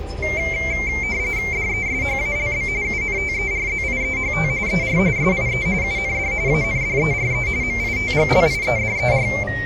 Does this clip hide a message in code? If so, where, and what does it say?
Yes: RTTY (45.45 baud, 170 Hz shift) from 0.2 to 9.4 s, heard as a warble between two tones, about 2200 Hz centre, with the noise inside a car. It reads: DESHALB UNTERZIEHT ER SIE UND ANDERE MITGLIEDER